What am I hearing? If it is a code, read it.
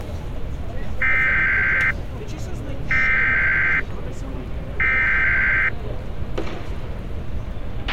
Emergency Alert System (SAME) tones (header bursts), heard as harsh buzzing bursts, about 520.83 baud, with a squelch burst at the end and street noise.